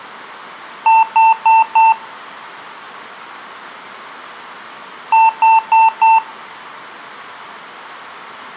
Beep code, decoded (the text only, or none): 4 short